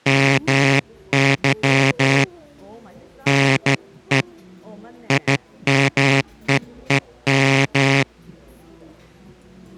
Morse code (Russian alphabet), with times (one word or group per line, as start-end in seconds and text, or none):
0.1-2.2 МЫ
3.3-4.2 НЕ
5.1-8.0 ИМЕЕМ